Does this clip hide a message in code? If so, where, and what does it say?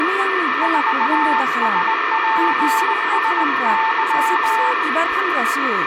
Yes: Morse code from 0.6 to 4.8 s, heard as a keyed tone, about 19 wpm, 890 Hz, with radio static, a steady whistle near 1800 Hz, room echo and speech in Bodo. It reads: 4SPSY